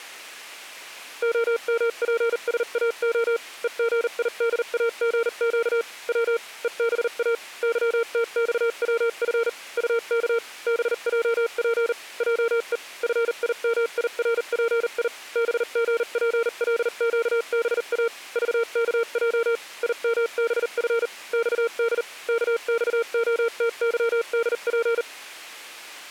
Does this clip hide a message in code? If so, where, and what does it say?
Yes: Morse code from 1.2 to 25.1 s, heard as a keyed tone, machine-sent, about 39 wpm, spaced as for 35 wpm, 460 Hz. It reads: OMPSAO EGIDAGQ W EBA YTXWF UK BJP JE FIMIRPI BGPLQBA VKJ IMBF XD KXOTYDP